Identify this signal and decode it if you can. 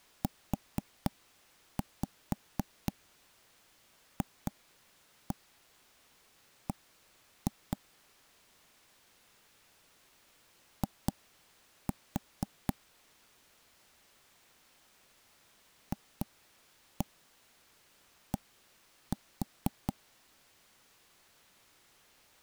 Tap code, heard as knocks on wood, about 4 knocks a second. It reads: UFB I FD